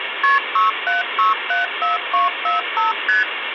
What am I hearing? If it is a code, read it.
Multi-frequency trunk signalling (R1, as on North American trunks), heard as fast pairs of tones, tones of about 150 ms, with phone line noise. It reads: KP 67674245 ST